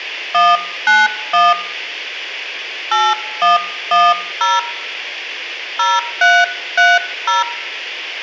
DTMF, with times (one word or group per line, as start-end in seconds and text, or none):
0.3-1.5 191
2.9-4.6 8110
5.8-7.4 0330